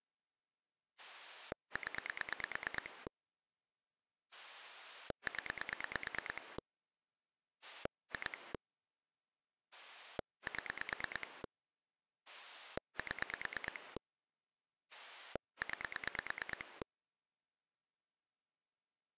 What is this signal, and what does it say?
Pulse dialling, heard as a rotary dial, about 9 pulses a second. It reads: 0 0 2 7 7 9